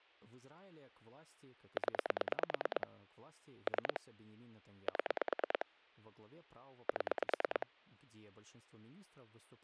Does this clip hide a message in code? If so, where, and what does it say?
Yes: pulse dialling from 1.8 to 7.6 s, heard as clicks on a phone line, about 9 pulses a second, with speech in Russian. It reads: 0 3 7 7